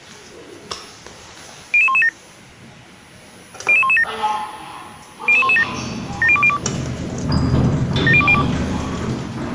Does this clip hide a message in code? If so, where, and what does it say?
Yes: five-tone selective call (ZVEI) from 1.7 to 8.4 s, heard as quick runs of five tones, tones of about 70 ms, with the noise inside a lift. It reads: 00117 00117 00117 70202 70202